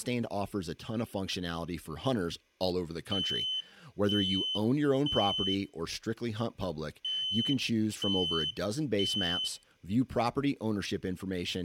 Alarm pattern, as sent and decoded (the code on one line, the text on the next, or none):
3 beeps and a pause
temporal three